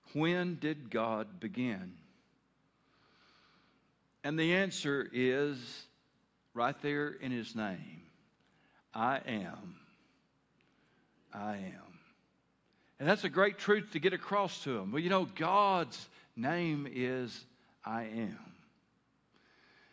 Speech in English. There is no code.